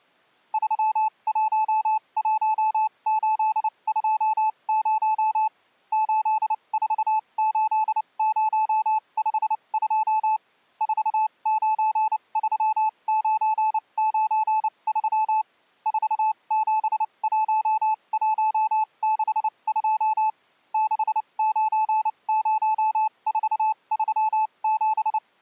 Morse code, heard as a keyed tone, machine-sent, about 29 wpm, spaced as for 24 wpm, 870 Hz. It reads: 311820 848052 493993 471162 690437